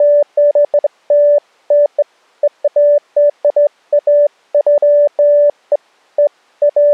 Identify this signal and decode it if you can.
Beeps of irregular length. There is no code.